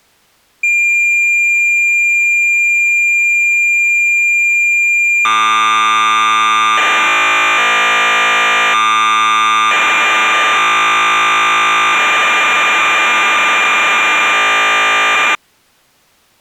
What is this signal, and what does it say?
Cassette data (Kansas City type), 1200 baud, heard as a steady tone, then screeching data.